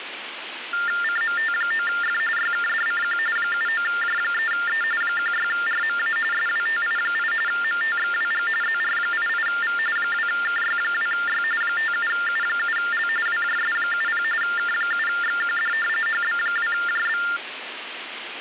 TTY/TDD text telephone tones (45.45 baud Baudot), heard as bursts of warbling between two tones, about 400 Hz shift, 1600 Hz centre, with phone line noise. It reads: CMT9F YKDCQ 79J3E 16RMA SWTI8 MTXWG ZR88V 2KY2Y 57U7L WJS70 K7XQD HB2JB